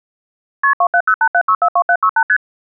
Multi-frequency trunk signalling (R1, as on North American trunks), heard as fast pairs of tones, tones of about 70 ms. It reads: KP 27087642768 ST